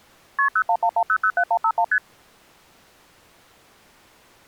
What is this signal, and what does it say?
Multi-frequency trunk signalling (R1, as on North American trunks), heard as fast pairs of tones, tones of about 70 ms. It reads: KP 0111007151 ST